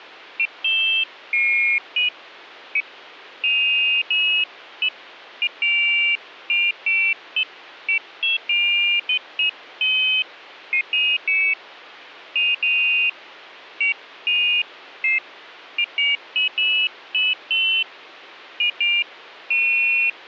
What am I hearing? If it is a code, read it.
Pairs of high tones at irregular times, with hum. There is no code.